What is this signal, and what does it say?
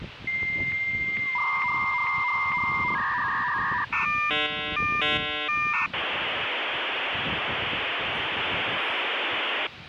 Dial-up modem handshake (V.34 or later), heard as a whistle, warbles, then hiss, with phone line noise and the noise of a park.